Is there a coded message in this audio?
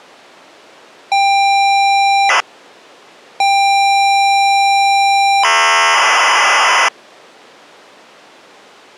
Yes: ZX Spectrum tape loading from 1.1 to 6.9 s, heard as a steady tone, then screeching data.